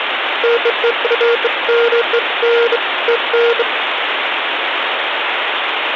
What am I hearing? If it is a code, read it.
Beeps of irregular length, with phone line noise. There is no code.